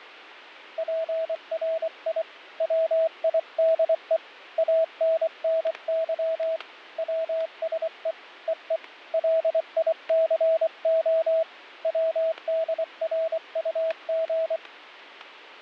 Morse code (Russian alphabet), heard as a keyed tone, hand-sent with a paddle, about 24 wpm, 650 Hz, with static crashes. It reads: ПРИ ВИДЕ АННЫ ВСЕ ЕЕ ЛИЦО ВДРУГ